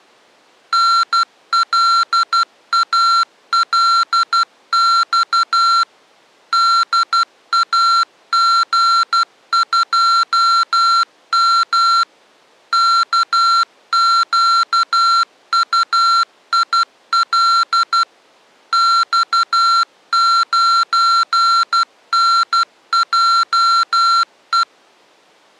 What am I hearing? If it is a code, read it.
Morse code, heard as electronic beeps, machine-sent, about 12 wpm, 1360 Hz. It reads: NLALX DAG2M KQUIL X9NJE